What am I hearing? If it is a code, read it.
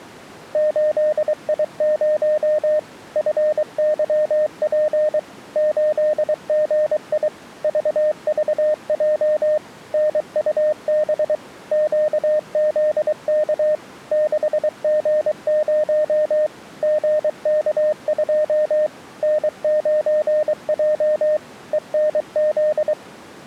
Morse code, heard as a keyed tone, machine-sent, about 23 wpm, 610 Hz. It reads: 8I0 FYP 8GI VVJ NUB QZK 6G0 GK2 N9J ENZ